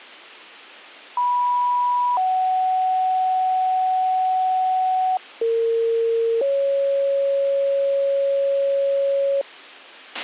Two-tone page, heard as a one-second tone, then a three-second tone, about 980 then 750 Hz, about 460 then 550 Hz, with a squelch burst at the end.